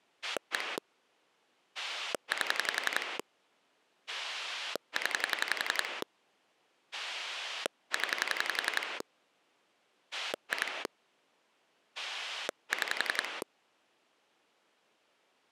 Pulse dialling, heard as a rotary dial, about 11 pulses a second. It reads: 1 8 0 0 2 6